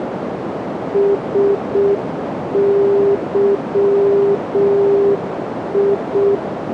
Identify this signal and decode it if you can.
Morse code, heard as a keyed tone, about 6 wpm, 400 Hz, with radio static and a narrow filter. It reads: SYI